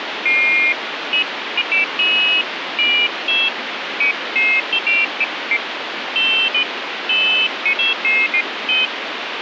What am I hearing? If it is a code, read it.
Pairs of high tones at irregular times, with phone line noise. There is no code.